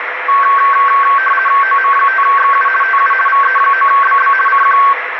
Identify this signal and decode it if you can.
RTTY (50 baud, 450 Hz shift), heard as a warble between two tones, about 1330 Hz centre, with radio static. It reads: OM5XU TU VE9BB CQ